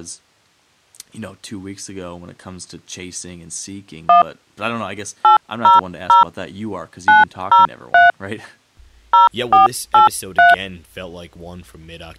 DTMF, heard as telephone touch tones, dialled by hand, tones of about 140 ms, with speech in English. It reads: 1 800 903 0483